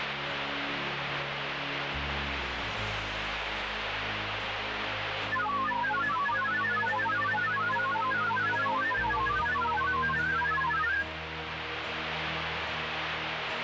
Multi-tone FSK (Olivia or MFSK type), about 1000 Hz wide, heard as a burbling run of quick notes, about 31.25 baud, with radio static.